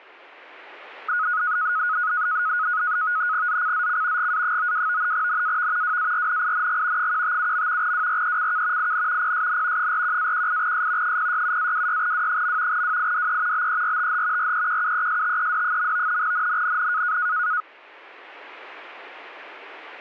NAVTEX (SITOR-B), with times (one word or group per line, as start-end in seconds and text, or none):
3.5-4.3 ZCZC
4.2-5.1 GA92
5.1-6.0 NAV
5.8-7.1 WARNING
7.0-7.9 157.
7.8-8.9 WRECK
8.8-9.3 IN
9.2-9.9 PSN
9.8-11.2 41-18S
11.0-12.8 067-26W.
12.7-13.7 WIDE
13.5-14.5 BERTH
14.4-16.2 REQUESTED.
16.2-17.2 NNNN